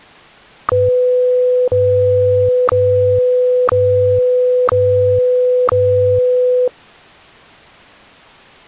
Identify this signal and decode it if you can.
Radio time signal (WWVH, Hawaii), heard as ticks, one a second.